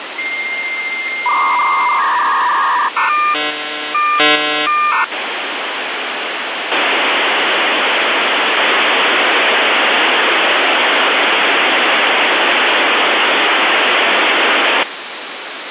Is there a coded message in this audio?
Yes: dial-up modem handshake (V.34 or later) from 0.2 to 14.8 s, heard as a whistle, warbles, then hiss, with phone line noise.